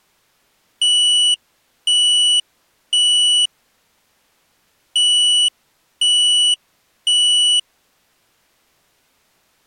Alarm pattern, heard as an alarm's beeps, played twice, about 2950 Hz. Temporal three. Smoke or fire, evacuate.